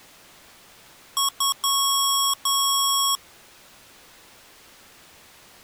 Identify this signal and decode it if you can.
Beep code, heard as beeps from a small speaker, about 1100 Hz. 2 short, 2 long.